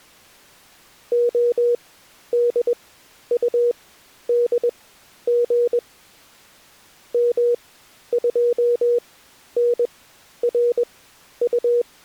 Morse code, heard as a keyed tone, machine-sent, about 21 wpm, spaced as for 11 wpm, 480 Hz. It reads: ODUDG M2NRU